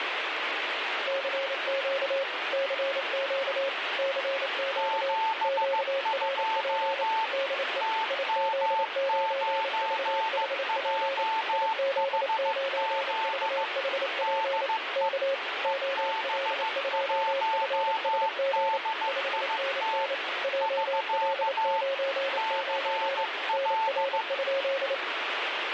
Morse code, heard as two keyed tones, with radio static. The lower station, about 28 wpm, 540 Hz: CQ CQ CQ QRP DE IZ9VHP IZ9VHP K OL2FSG 5NN JL99 NR?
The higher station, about 15 wpm, 890 Hz: 72 TM9JHZ DE EB1DIT <SK> CL